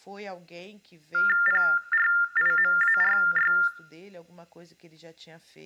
TTY/TDD text telephone tones (45.45 baud Baudot), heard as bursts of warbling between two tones, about 400 Hz shift, 1600 Hz centre, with room echo and speech in Portuguese. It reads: PRIMARY